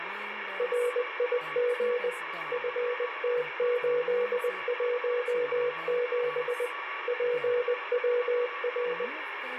Morse code, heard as a keyed tone, machine-sent, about 20 wpm, 490 Hz, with radio static, a weaker station near 1140 Hz, room echo and speech in English. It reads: RIG FT817 PWR